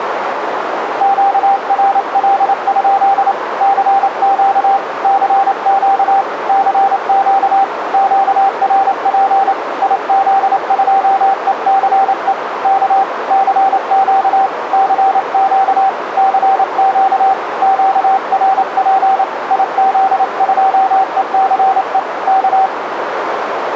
Morse code, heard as a keyed tone, hand-sent with a paddle, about 28 wpm, 780 Hz, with radio static and a narrow filter. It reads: QRL? CQ CQ CQ QRP IZ2ECE K CQ CQ CQ QRP IZ2ECE K